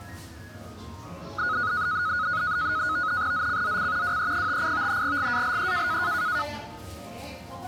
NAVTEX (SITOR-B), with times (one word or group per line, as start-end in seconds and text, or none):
3.3-4.2 ZCZC
4.0-5.0 WE58
5.0-6.0 GALE